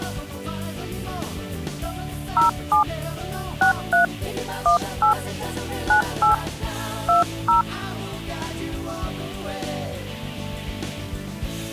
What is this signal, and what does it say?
DTMF, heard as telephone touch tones, dialled by hand, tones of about 120 ms. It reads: 07 63 18 98 20